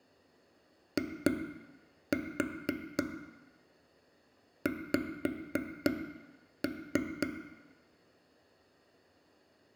Tap code, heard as taps on a table, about 4 knocks a second, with room echo. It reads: IX